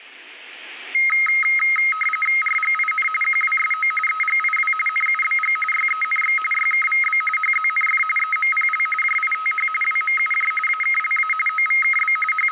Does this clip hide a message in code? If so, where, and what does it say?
Yes: RTTY (45.45 baud, 850 Hz shift) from 0.9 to 12.5 s, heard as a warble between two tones, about 1700 Hz centre, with static crashes. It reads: RGIN QWSO EGIW NUBG YENX YKVB HZNF EMPL JITH WMUJ AKLA OVKB …